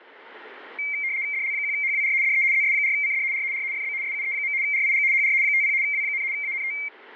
RTTY (75 baud, 170 Hz shift), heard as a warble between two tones, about 2200 Hz centre. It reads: DL1HWR DE ZS4CD R R FB SUE. RIG HR 50 W, ANT